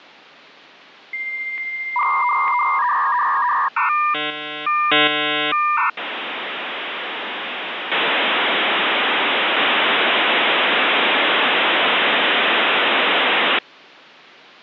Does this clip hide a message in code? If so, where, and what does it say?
Yes: dial-up modem handshake (V.34 or later) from 1.1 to 13.6 s, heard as a whistle, warbles, then hiss.